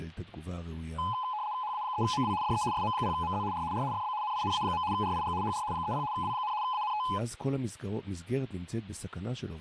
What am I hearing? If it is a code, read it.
RTTY (75 baud, 170 Hz shift), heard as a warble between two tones, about 930 Hz centre, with static crashes and speech in Hebrew. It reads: HA3MW DE SM0MZ R R FB NINA. RIG HR 30 W, ANT